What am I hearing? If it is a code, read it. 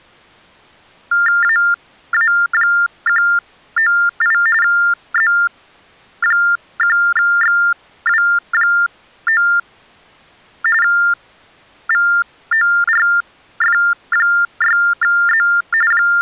TTY/TDD text telephone tones (45.45 baud Baudot), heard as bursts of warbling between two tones, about 400 Hz shift, 1600 Hz centre. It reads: AA198 Z1XW9 VORF6Z …